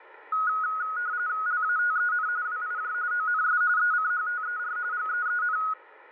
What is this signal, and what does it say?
RTTY (45.45 baud, 170 Hz shift), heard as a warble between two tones, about 1360 Hz centre, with radio static. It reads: LATEN WIJ ONS ECHTER GEEN